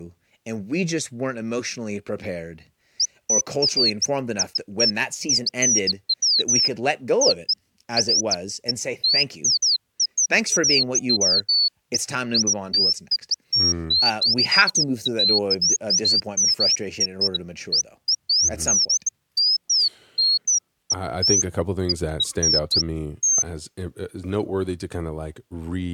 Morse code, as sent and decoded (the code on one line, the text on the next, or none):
none